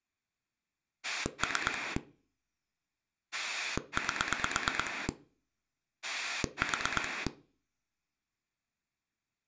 Pulse dialling, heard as a rotary dial, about 8 pulses a second. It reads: 3 8 4